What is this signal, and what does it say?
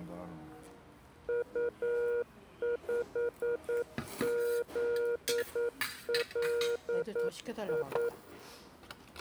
Morse code, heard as a keyed tone, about 9 wpm, 480 Hz, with the noise of a restaurant. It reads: U5ZLI